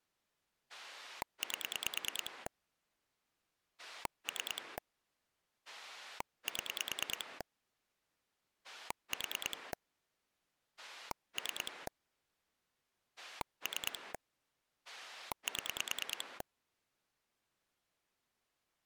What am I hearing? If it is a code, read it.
Pulse dialling, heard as a rotary dial, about 9 pulses a second. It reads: 8 3 7 4 3 3 7